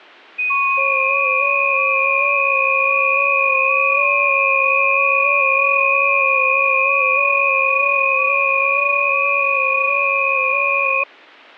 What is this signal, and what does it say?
FT8 (several signals at once), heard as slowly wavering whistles, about 6.25 baud.